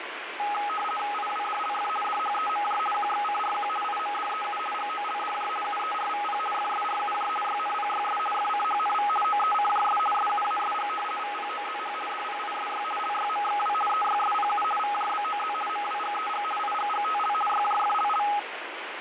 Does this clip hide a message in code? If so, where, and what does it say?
Yes: RTTY (50 baud, 450 Hz shift) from 0.4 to 18.4 s, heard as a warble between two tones, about 1050 Hz centre, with radio static and fading. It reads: IWDLF DHEMJ QXCRQ IMDEU GOLDJ UERVP FSRUJ YNPYS FCHNV OECJS SUASG VPOZH DPISY LYMXW EYSPU VJBOZ MWGEG IGGTL YJFLL